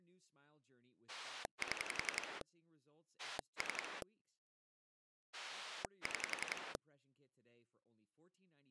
Pulse dialling, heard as a rotary dial, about 11 pulses a second, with speech in English. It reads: 7 3 6